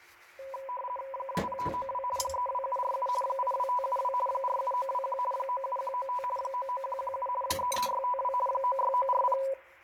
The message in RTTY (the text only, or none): 20592 32747 82572 47921 97195 99117 33652 96940